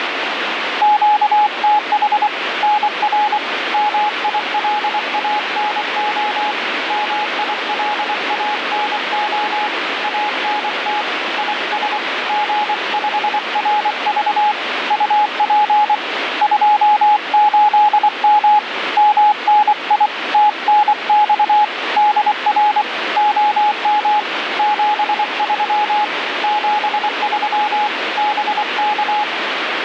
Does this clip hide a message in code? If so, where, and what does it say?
Yes: Morse code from 0.8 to 29.3 s, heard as a keyed tone, hand-sent with a paddle, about 24 wpm, 840 Hz, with radio static. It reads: QTH NR MILANO MILANO ANT IS G5RV UP 28M MNI TNX DR OM 73 73 BK